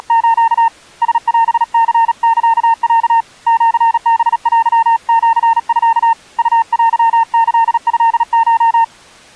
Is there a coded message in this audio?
Yes: Morse code (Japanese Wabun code) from 0.0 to 8.9 s, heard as a keyed tone, hand-sent with a paddle, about 37 wpm, 910 Hz. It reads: … ラオニサロ シハテシミ ウテキトコ